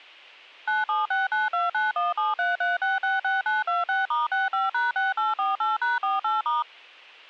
DTMF, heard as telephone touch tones, dialled by machine, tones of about 170 ms, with a squelch burst at the end. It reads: 9769291733666926*65#6848#48*